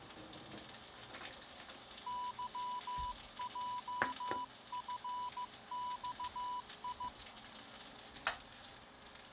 Morse code, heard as a keyed tone, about 15 wpm, 990 Hz, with kitchen noise. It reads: YJFXI